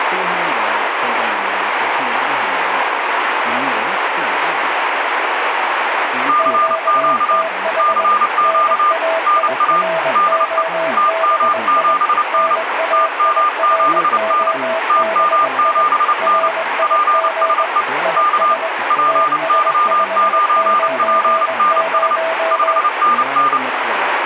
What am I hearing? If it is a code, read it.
Morse code, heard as two keyed tones, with radio static. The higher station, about 29 wpm, 1200 Hz: CQ CQ NA DE TM7N TM7N TM7N PSE K PY9PNS 5NN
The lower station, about 21 wpm, 650 Hz: QTH NAIROBI NAIROBI RIG IS TS590